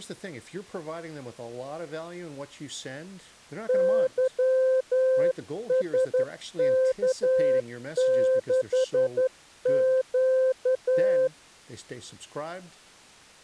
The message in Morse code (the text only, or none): YSK6Q